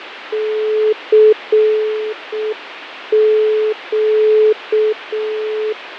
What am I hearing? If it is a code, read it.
Morse code, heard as a keyed tone, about 6 wpm, 430 Hz, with radio static and fading. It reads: CQ